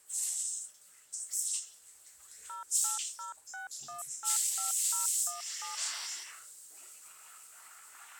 DTMF, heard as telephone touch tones, dialled by machine, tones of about 130 ms, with the noise of a restroom. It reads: 0806185017